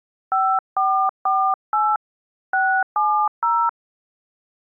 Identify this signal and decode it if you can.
DTMF, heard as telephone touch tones, dialled by hand, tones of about 280 ms. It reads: 5448 670